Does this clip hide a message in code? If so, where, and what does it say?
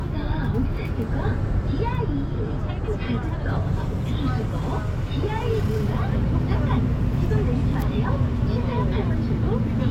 No, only the noise inside a bus.